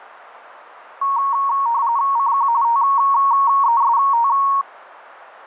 RTTY (45.45 baud, 170 Hz shift), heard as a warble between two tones, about 1020 Hz centre, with radio static. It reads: CQ TEST